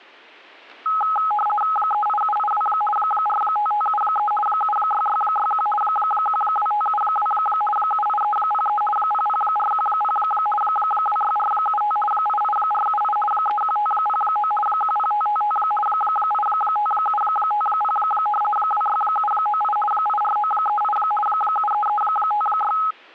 RTTY (50 baud, 450 Hz shift), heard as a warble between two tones, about 1060 Hz centre, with static crashes. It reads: 38782 45573 76661 12572 78303 00410 26475 88478 31509 10555 85750 26798 84938 73356